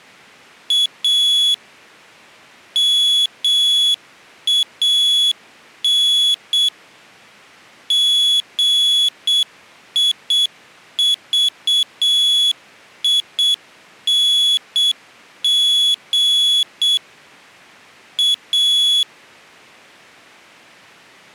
Morse code, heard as a high beeper, machine-sent, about 7 wpm, 3400 Hz. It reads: A MAN GIVING A